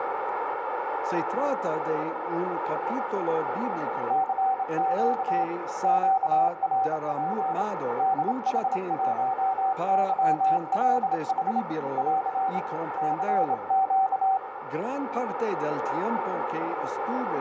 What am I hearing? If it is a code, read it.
Morse code, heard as a keyed tone, hand-sent with a straight key, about 27 wpm, 770 Hz, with heavy radio static and a narrow filter. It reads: CQ QRP DH1YLH <AR> CQ